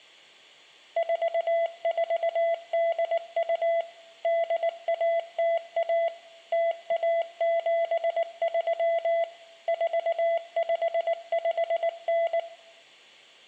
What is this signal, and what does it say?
Morse code (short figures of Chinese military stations), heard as a keyed tone, machine-sent, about 19 wpm, 670 Hz, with room echo. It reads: 4482 8101 0173 4559